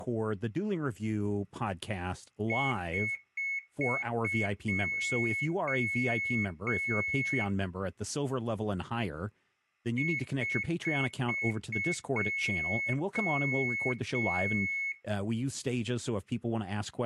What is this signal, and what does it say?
Beep code, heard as a piezo beeper, played twice, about 2200 Hz, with speech in English. 5 short, 3 long.